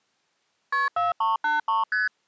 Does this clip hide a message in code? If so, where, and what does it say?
Yes: multi-frequency trunk signalling (R1, as on North American trunks) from 0.7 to 2.1 s, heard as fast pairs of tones, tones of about 160 ms. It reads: KP 4383 ST